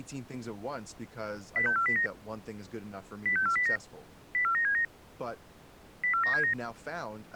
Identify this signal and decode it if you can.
Five-tone selective call (CCIR), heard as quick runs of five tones, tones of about 100 ms, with speech in English. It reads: 06409 06409 04979 04979